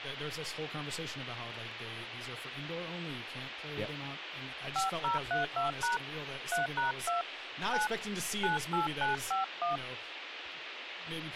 DTMF, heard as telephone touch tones, dialled by hand, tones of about 140 ms, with radio hiss and speech in English. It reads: 5032# 3#2 9 98951